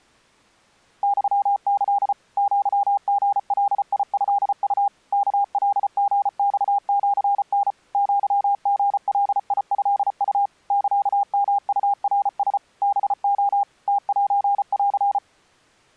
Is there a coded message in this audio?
Yes: Morse code (Japanese Wabun code) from 1.0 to 15.2 s, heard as a keyed tone, machine-sent, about 34 wpm, 800 Hz. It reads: ユキ アリガトウ ワカリマシタ アリガトウ サヨウナラ ハレ ムセン